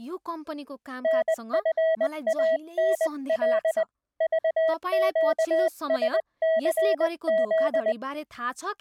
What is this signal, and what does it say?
Morse code, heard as a keyed tone, hand-sent with a paddle, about 20 wpm, 650 Hz, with speech in Nepali. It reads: NFANL VQSCZ